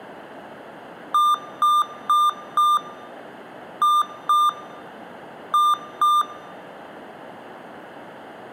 Beep code, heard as beeps from a small speaker, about 1200 Hz, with room echo. 4-2-2. In Phoenix BIOS tables: shutdown test failure.